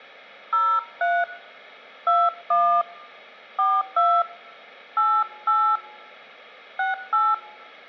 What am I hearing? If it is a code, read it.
DTMF, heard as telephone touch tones, dialled by hand, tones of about 250 ms. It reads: 03 21 42 88 68